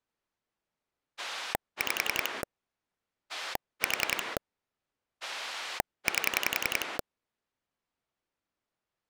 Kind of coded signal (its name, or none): pulse dialling